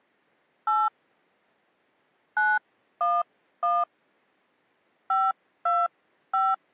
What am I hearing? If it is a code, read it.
DTMF, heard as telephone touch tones, dialled by hand, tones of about 210 ms. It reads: 8 911 525